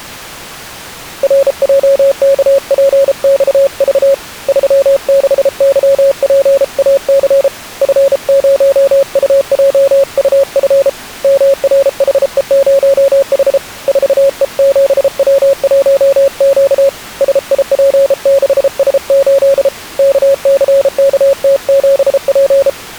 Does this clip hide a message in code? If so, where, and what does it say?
Yes: Morse code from 1.2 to 22.8 s, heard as a keyed tone, hand-sent with a bug key, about 33 wpm, 550 Hz. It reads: RJKPXV 36YPAC F0UJUF MRHE0H 4E7W1Q SIP6S8 KCKT7P